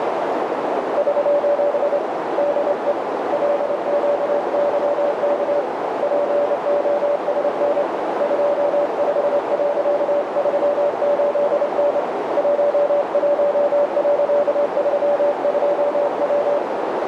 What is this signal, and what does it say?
Morse code, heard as a keyed tone, hand-sent with a straight key, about 27 wpm, 580 Hz, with heavy radio static and a narrow filter. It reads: <SOS> DE LQYK POSN 25.38N 11.32W